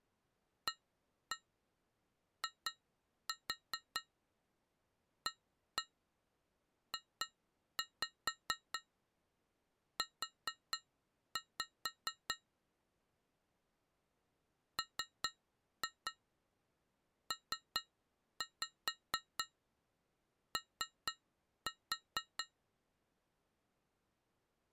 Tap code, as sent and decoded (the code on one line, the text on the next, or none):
1-1 2-4 1-1 2-5 4-5 / 3-2 3-5 3-4
AIAJU MPO